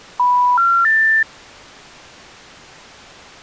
Telephone call progress tone (North American plan), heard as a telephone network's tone, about 980, 1370, 1800 Hz. Special information tone.